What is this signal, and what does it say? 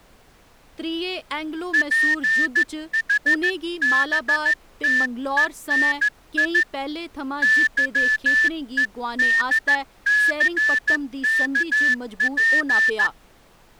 Morse code (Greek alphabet), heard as a whistle, hand-sent with a straight key, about 14 wpm, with speech in Dogri. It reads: ΠΗΒΤΕΝΙ ΥΕΔΘΚΠ